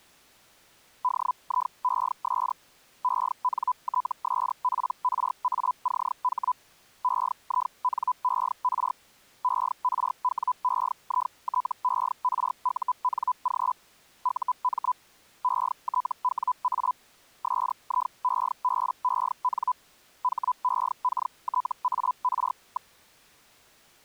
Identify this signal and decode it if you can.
Hellschreiber (Feld-Hell, 122.5 baud), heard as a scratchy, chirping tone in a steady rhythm, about 1000 Hz. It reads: DIES ENTSPRACH EINER ERWEITERUNG UM ETWA SIEBEN HEKTAR.